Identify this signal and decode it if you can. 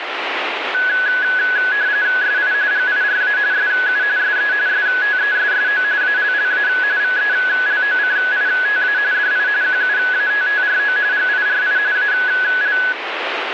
RTTY (45.45 baud, 170 Hz shift), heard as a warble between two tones, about 1600 Hz centre, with radio static. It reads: SI GIRA SU SE STESSO ALLA VELOCITA DI QUATTRO GIRI AL